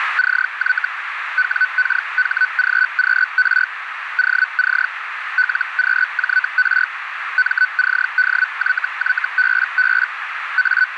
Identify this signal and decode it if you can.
Hellschreiber (Feld-Hell, 122.5 baud), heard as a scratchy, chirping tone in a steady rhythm, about 1500 Hz, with radio static and a narrow filter. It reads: CY WKHGQR OC LQJR MCDYYBB …